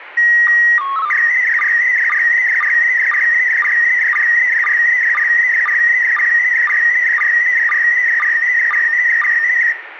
SSTV (slow-scan television), PD 120, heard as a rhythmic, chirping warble, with radio static and room echo.